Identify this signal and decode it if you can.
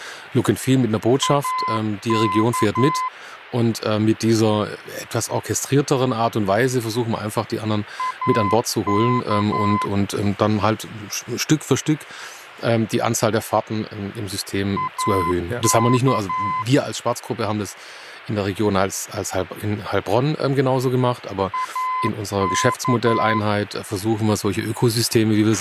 Morse code, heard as a keyed tone, machine-sent, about 11 wpm, 1020 Hz, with a squelch burst at the end and speech in German. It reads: AK AK AK AK